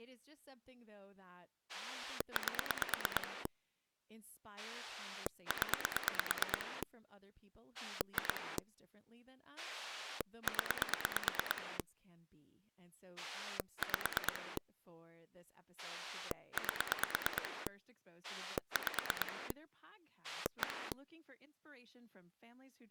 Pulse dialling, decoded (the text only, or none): 8 0 2 0 5 8 5 1